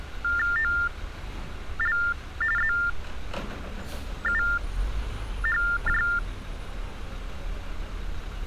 TTY/TDD text telephone tones (45.45 baud Baudot), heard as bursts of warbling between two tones, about 400 Hz shift, 1600 Hz centre, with street noise. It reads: OL ZUHJ